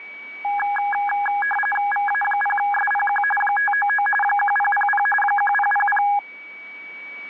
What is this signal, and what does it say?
RTTY (45.45 baud, 850 Hz shift), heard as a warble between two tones, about 1240 Hz centre, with a steady whistle near 2270 Hz. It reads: VA0SPQ 599 1000 1000